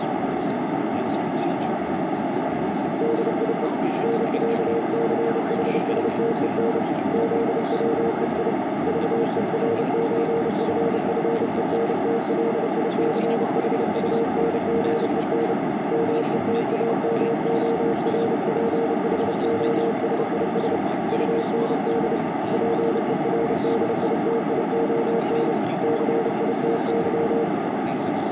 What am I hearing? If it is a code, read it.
Morse code (with German letters), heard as a keyed tone, hand-sent with a paddle, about 30 wpm, 460 Hz, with radio static, a narrow filter and speech in English. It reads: DIE NÄCHSTEN ZWEI VERÖFFENTLICHUNGEN METAMORPHOSIS UND PERDITION CITY